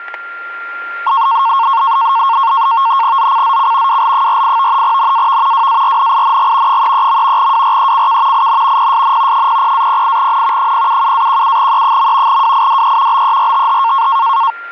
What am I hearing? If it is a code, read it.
NAVTEX (SITOR-B), 100 baud, 170 Hz shift, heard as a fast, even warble, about 1000 Hz centre, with static crashes and a steady whistle near 1390 Hz. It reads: ZCZC WL48 NAV WARNING 33. WRECK IN PSN 00-08N 077-17E. WIDE BERTH